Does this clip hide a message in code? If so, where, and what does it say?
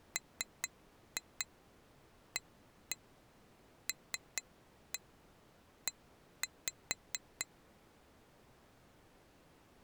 Yes: tap code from 0.2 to 7.5 s, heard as taps on glass, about 4 knocks a second. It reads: MALE